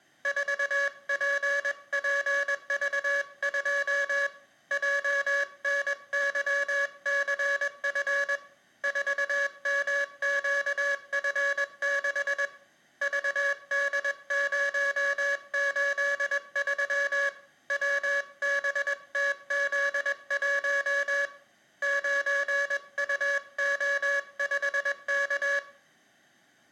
Morse code, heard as a buzzer, hand-sent with a paddle, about 21 wpm, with room echo. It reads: 4PPV2 JNYCF 4MQF6 VD083 WBTZ1 9UO5K